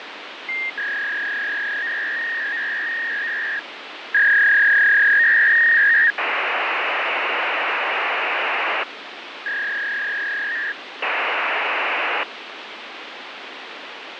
Fax machine handshake, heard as a warble and hiss, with phone line noise.